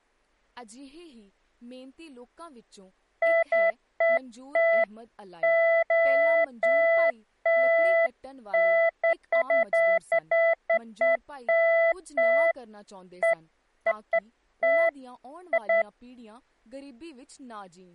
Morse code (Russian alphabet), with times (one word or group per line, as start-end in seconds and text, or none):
none